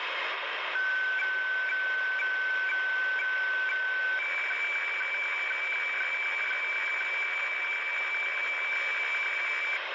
Weather fax (radiofax), 120 lines a minute, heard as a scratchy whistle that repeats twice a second, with radio static.